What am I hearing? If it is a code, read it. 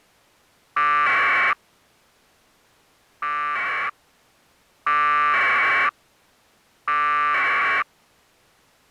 Packet radio (AX.25, as in APRS), 1200 baud, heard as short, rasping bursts.